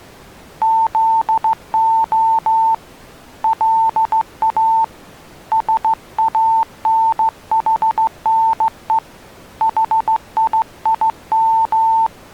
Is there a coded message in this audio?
Yes: Morse code (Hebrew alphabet) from 0.6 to 12.1 s, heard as a keyed tone, hand-sent with a straight key, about 15 wpm, 900 Hz. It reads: זה לא שאנחנו חיים